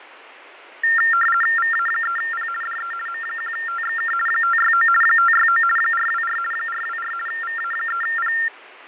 RTTY (50 baud, 450 Hz shift), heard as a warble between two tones, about 1600 Hz centre, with radio static and fading. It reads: VA3P DE M1TXK 569 569 424 424 VA3P